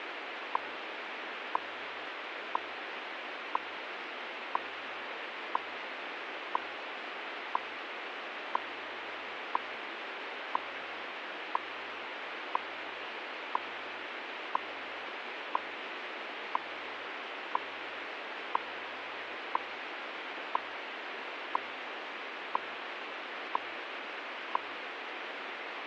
Radio time signal (WWV, Colorado), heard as ticks, one a second, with radio static.